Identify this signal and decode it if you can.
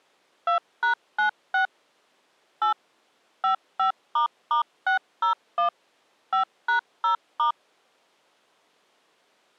DTMF, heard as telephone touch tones, dialled by machine, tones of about 110 ms. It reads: 2#96 8 55**601 5#0*